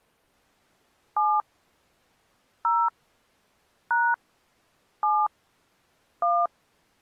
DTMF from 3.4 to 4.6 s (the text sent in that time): #